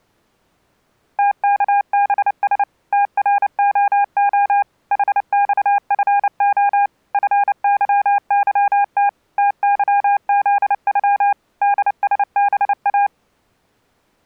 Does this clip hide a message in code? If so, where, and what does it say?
Yes: Morse code (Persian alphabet) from 1.1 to 13.1 s, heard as a keyed tone, machine-sent, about 29 wpm, 810 Hz. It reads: تکبس ترعع حخفع فظظت تظزغ دسبا